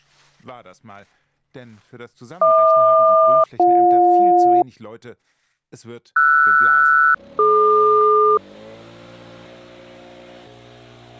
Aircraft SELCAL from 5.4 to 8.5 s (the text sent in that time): RS-DQ